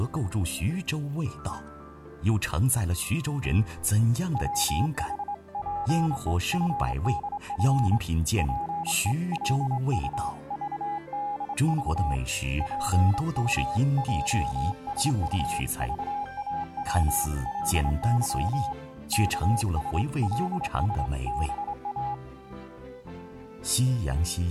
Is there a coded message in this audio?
Yes: Morse code (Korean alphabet) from 4.3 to 22.2 s, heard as a keyed tone, hand-sent with a straight key, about 25 wpm, 820 Hz. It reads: 부자는 자기를 지혜롭게 여겨도